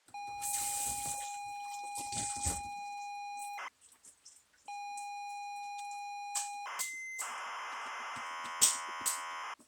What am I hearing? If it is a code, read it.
ZX Spectrum tape loading, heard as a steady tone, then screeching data, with the noise of a restroom.